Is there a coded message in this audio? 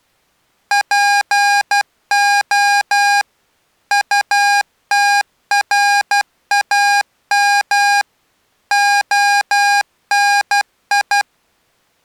Yes: Morse code (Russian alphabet) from 0.7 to 11.3 s, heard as electronic beeps, machine-sent, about 12 wpm, 810 Hz. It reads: ПО УТРАМ ОНИ